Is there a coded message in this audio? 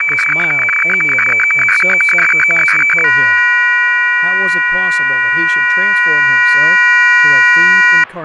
Yes: weather fax (radiofax), 120 lines a minute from 0.0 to 8.0 s, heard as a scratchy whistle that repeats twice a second, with speech in English.